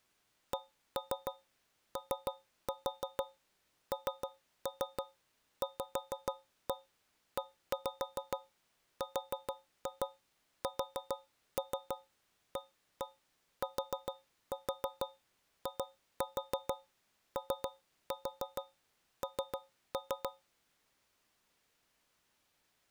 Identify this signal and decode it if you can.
Tap code, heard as taps on a metal pipe, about 6 knocks a second. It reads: CONVERSATION